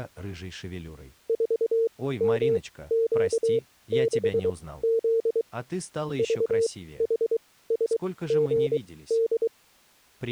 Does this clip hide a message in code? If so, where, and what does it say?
Yes: Morse code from 1.2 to 9.5 s, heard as a keyed tone, machine-sent, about 23 wpm, spaced as for 16 wpm, 460 Hz. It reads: 4MQ6Z VHSGD